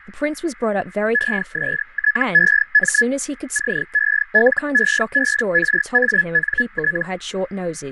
Hellschreiber (Feld-Hell, 122.5 baud), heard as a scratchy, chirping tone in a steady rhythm, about 1700 Hz, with radio static, fading and speech in English. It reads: ESTEM CELEBRANT